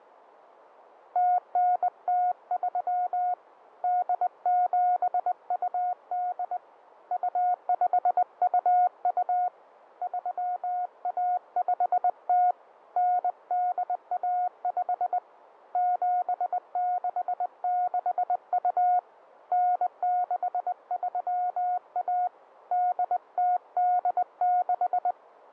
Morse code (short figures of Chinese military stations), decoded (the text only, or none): 0903 8728 2522 3150 9815 7662 9631 8086